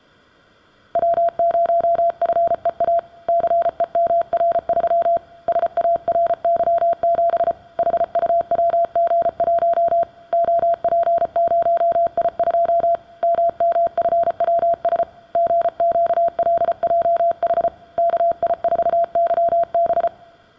Morse code, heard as a keyed tone, hand-sent with a paddle, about 34 wpm, 680 Hz. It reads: W0FEA CEMR3 SARY7 HUWG1 OP0I2 MMFWS GQLJH KI4YB